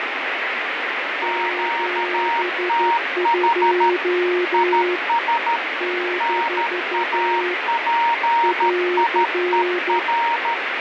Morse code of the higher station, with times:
1.2-3.9 QTH
4.5-5.6 IS
6.2-10.5 NAPIER

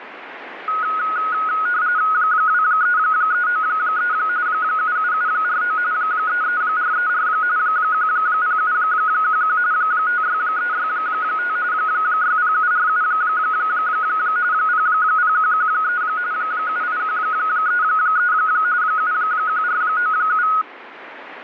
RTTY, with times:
2.1-4.1 23393
4.5-5.8 77749
5.9-7.3 33434
7.6-9.6 10711
9.7-11.6 56365
11.7-13.0 60747
14.5-16.0 00113
16.3-18.3 78133
18.8-20.5 71497

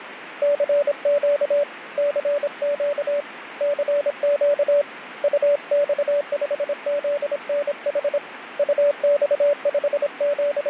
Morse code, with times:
0.4-1.6 CQ
2.0-3.2 CQ
3.6-4.8 CQ
5.2-8.2 UX5ZNH
8.6-10.7 …

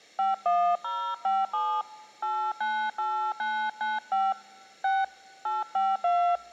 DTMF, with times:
0.2-1.8 51057
2.2-4.3 898995
4.8-5.0 6
5.5-6.4 852

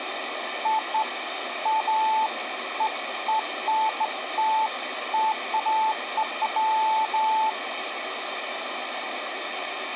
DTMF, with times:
none

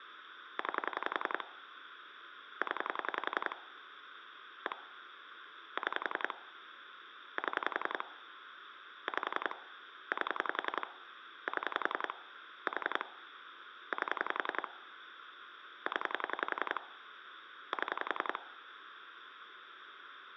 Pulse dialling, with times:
0.6-1.4 9
2.6-3.6 0
4.7-4.8 1
5.8-6.3 6
7.4-8.0 7
9.1-9.6 5
10.1-10.9 8
11.5-12.1 7
12.7-13.0 4
13.9-14.7 8
15.9-16.8 0
17.7-18.4 7

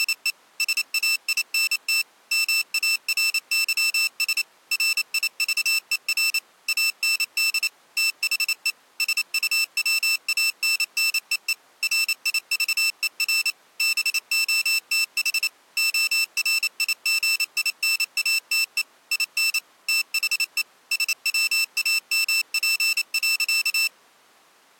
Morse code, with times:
0.0-0.3 …
0.6-2.0 SAINT
2.3-4.4 MARYS
4.7-6.4 RIVER
6.7-7.7 AND
8.0-8.7 THE
9.0-11.5 SUWANNEE
11.8-13.5 RIVER
13.8-15.5 BOTH
15.8-18.8 ORIGINATE
19.1-19.6 IN
19.9-20.6 THE
20.9-23.9 SWAMP.

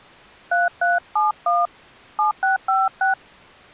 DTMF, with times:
0.5-1.7 3371
2.2-3.1 7656

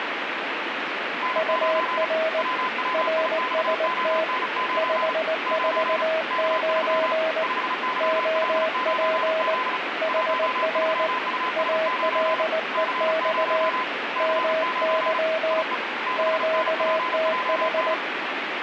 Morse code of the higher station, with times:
1.2-2.1 N9
2.4-5.1 WWIXON9
5.5-6.0 9
6.3-7.1 K3
7.4-9.8 5YL9Z
10.1-12.4 13US9
12.7-13.8 C0
14.2-15.2 C9
15.5-15.7 IE
16.1-17.9 6NPJN

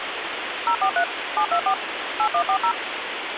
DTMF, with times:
0.7-1.0 043
1.4-1.7 724
2.2-2.7 8140

